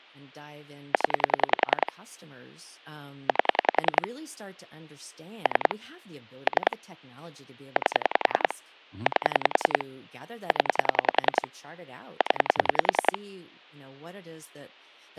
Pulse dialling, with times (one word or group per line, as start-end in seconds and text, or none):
0.9-1.9 0
3.3-4.1 8
5.5-5.7 3
6.5-6.8 3
7.8-8.5 8
9.1-9.8 8
10.5-11.5 0
12.2-13.2 0